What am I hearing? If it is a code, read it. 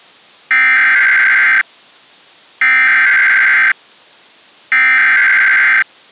Emergency Alert System (SAME) tones (header bursts), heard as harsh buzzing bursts, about 520.83 baud.